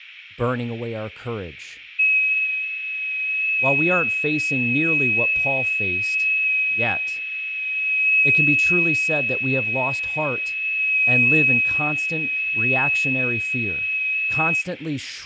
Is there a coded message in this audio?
Yes: FT8 (one signal) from 2.0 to 14.6 s, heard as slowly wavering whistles, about 6.25 baud, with radio static, fading, a narrow filter, room echo and speech in English.